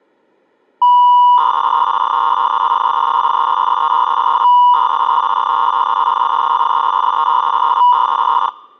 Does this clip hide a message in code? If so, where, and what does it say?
Yes: 300-baud modem data (V.21 tones) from 0.8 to 8.5 s, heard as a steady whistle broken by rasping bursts, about 300 baud, 200 Hz shift.